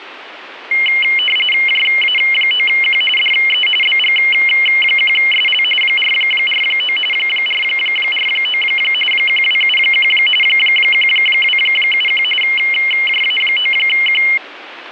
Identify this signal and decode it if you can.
RTTY (45.45 baud, 850 Hz shift), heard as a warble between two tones, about 2550 Hz centre, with radio static. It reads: JA9Q DE BG1SL 449 449 1271 1271 JA9Q